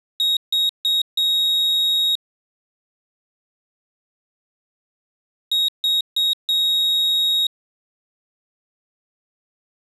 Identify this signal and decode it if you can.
Beep code, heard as a piezo beeper, played twice, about 3750 Hz. 3 short, 1 long.